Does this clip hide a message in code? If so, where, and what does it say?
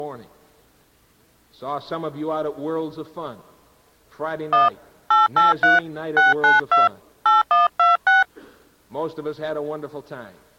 Yes: DTMF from 4.5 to 8.2 s, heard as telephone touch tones, dialled by hand, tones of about 160 ms. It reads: 1 883 692 8126